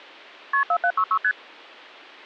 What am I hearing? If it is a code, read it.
Multi-frequency trunk signalling (R1, as on North American trunks), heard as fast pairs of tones, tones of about 70 ms. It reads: KP 4766 ST